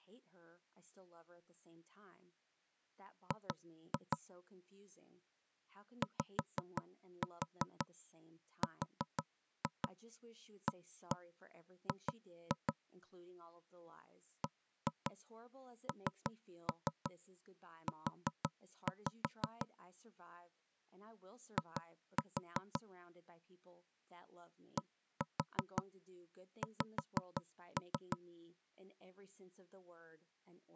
Tap code, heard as knocks on wood, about 5 knocks a second, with speech in English. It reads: G YRAG BNU I DX